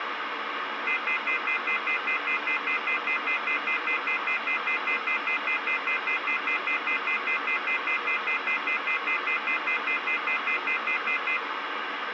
Telephone call progress tone (North American plan), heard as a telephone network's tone, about 1400, 2050, 2450, 2600 Hz, 0.1 s on and 0.1 s off, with phone line noise. Off-hook warning tone.